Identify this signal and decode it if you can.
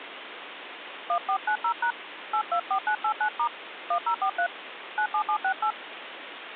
DTMF, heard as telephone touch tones, dialled by hand, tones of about 80 ms, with phone line noise. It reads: 1490# 824989* 1043 97768